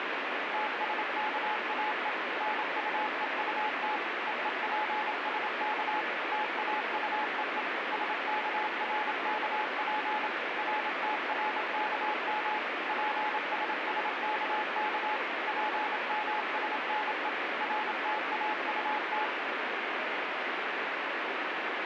Morse code, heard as a keyed tone, machine-sent, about 27 wpm, 850 Hz, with heavy radio static. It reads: TSKAE NUEUT EEPSK TAUEE SKRKP RTRKM PSSKK PMSNE RTAUT